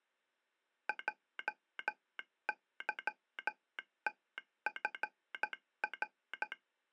Morse code, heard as a telegraph sounder, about 13 wpm. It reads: JYTFR